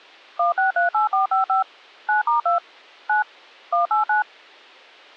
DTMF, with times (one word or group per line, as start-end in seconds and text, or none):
0.4-1.6 1638455
2.1-2.6 9*2
3.1-3.2 9
3.7-4.2 189